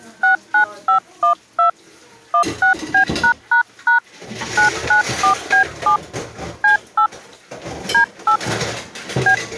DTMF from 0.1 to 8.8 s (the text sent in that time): 69512 16B### 994B7 C8 D8